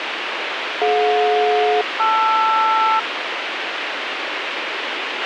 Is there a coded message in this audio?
Yes: aircraft SELCAL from 0.8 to 3.0 s, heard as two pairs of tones, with radio hiss and a squelch burst at the end. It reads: DJ-LR